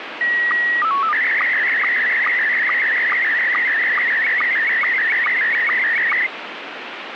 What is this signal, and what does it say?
SSTV (slow-scan television), Scottie S1, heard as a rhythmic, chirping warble, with radio static.